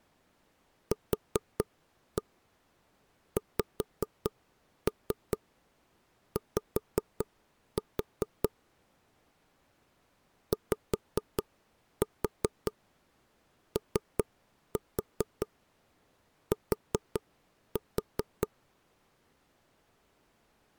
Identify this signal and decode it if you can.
Tap code, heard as taps on a table, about 4 knocks a second. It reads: QXY YOT